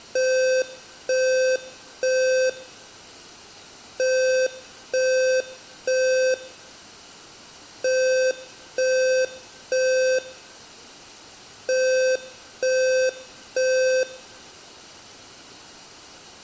Alarm pattern, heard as an alarm's beeps, played four times, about 520 Hz, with room echo. Temporal three. Smoke or fire, evacuate.